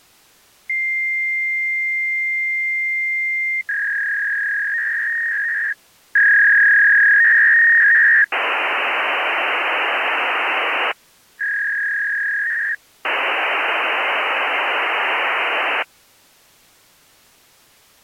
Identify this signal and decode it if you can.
Fax machine handshake, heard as a long tone, a warble and hiss.